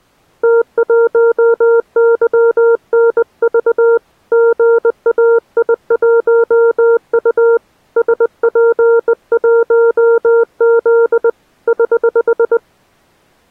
Morse code, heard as a keyed tone, hand-sent with a bug key, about 20 wpm, 460 Hz. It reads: T1YNV GAI1U SP1Z <HH>